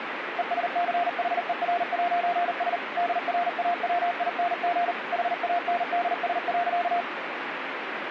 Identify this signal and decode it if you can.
Morse code, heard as a keyed tone, machine-sent, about 39 wpm, 700 Hz, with radio static. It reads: ESCHER'S DRAWING HANDS.